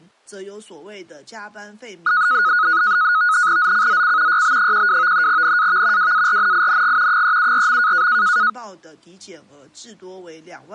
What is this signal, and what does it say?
NAVTEX (SITOR-B), 100 baud, 170 Hz shift, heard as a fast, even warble, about 1360 Hz centre. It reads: ZCZC YB12 NAV WARNING 374.